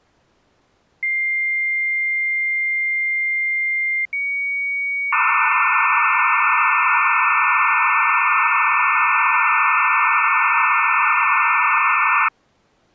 Dial-up modem handshake (low-speed, two carriers), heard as two whistles, then hiss.